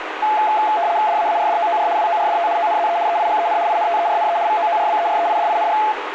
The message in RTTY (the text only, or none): DAARDOOR WORDT ONZE EIGEN INTERNE VOORBEREIDING